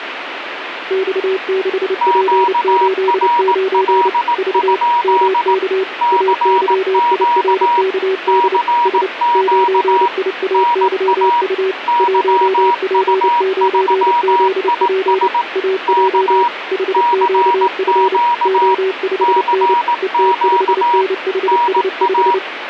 Morse code, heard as two keyed tones, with radio static. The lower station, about 29 wpm, 380 Hz: X6P89 V MK AYIRKD S 9IAYU 1P9ZP AJ HQF O5N ET5NHS5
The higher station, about 18 wpm, 960 Hz: QRL? CQ CQ NA YU3IS K CQ CQ NA